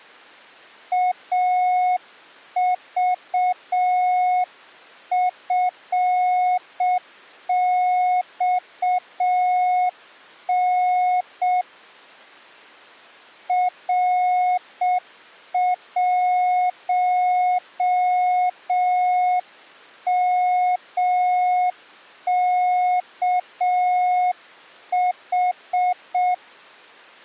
Morse code, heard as a keyed tone, hand-sent with a straight key, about 6 wpm, 730 Hz. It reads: AVFXN R1MKH